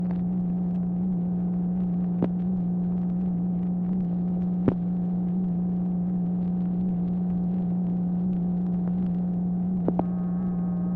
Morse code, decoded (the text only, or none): none